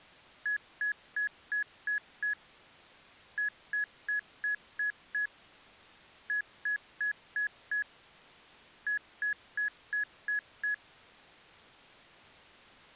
Beep code, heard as beeps from a small speaker, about 1700 Hz. 6-6-5-6.